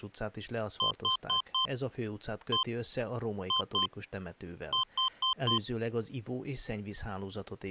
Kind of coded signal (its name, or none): beep code